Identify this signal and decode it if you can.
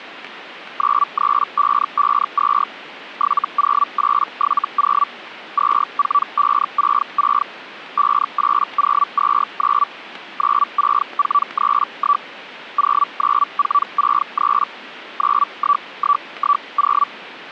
Hellschreiber (Feld-Hell, 122.5 baud), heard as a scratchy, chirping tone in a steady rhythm, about 1150 Hz. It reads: 93552 70870 24566 58029 96431 09463 91110